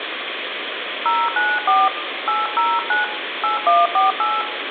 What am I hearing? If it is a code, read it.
DTMF, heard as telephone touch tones, dialled by hand, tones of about 200 ms, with phone line noise and room echo. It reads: 094 809 8148